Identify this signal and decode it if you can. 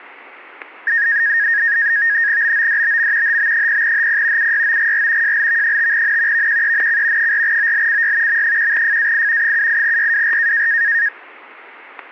NAVTEX (SITOR-B), 100 baud, 170 Hz shift, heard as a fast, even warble, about 1750 Hz centre, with static crashes. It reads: BODBM HB0HP UYOGR JLV5N VQENC 4OLCY M1FAI 78YWR